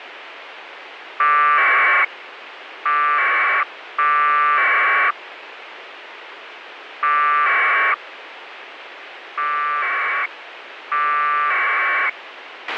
Packet radio (AX.25, as in APRS), 1200 baud, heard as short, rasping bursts, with radio hiss and a squelch burst at the end.